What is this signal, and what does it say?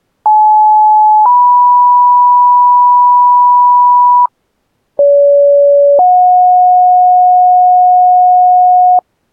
Two-tone page, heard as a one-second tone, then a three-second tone, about 860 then 980 Hz, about 570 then 730 Hz.